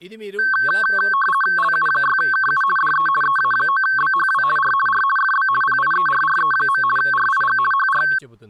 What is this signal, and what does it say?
RTTY (50 baud, 450 Hz shift), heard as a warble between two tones, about 1320 Hz centre, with speech in Telugu. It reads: LU6KU DE EA9BHW R R FB PIERRE. RIG HR